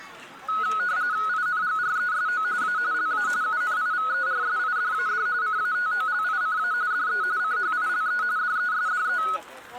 RTTY (45.45 baud, 170 Hz shift), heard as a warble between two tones, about 1370 Hz centre, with static crashes and the noise of a park. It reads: INGRESO A LA UNIVERSIDAD CATOLICA DE CHILE DESDE